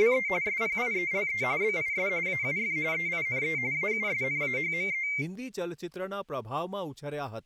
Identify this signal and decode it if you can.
RTTY (45.45 baud, 170 Hz shift), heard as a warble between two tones, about 2200 Hz centre, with speech in Gujarati. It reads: … SPIELE BIS AUF EINE AUSNAHME